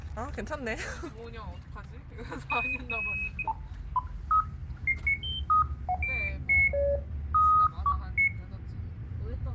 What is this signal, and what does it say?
Electronic bleeps of random pitch and length, with the noise inside a car. There is no code.